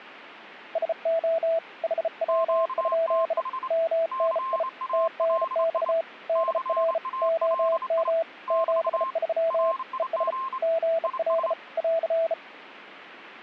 Morse code, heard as two keyed tones. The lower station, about 34 wpm, 660 Hz: SO HW? MNI TNX DR OM 73 ES GL <AR>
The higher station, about 27 wpm, 1060 Hz: QTH CALI CALI <BT> RIG IS